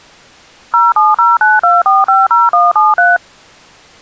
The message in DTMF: 07092450173

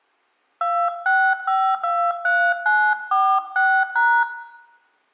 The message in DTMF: 26523946#

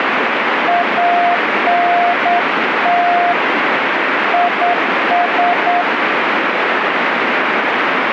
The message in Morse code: ANT IS

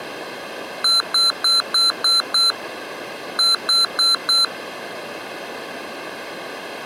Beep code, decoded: 6-4

